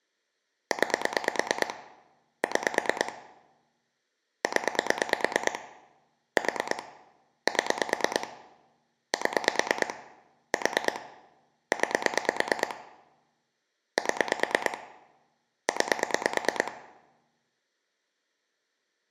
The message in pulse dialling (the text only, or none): 9 6 0 4 7 7 4 9 7 9